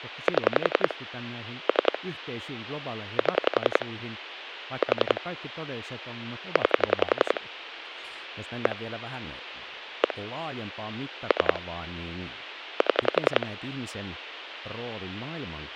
Pulse dialling, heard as clicks on a phone line, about 11 pulses a second, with speech in Finnish. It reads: 7 3 7 4 9 1 1 3 7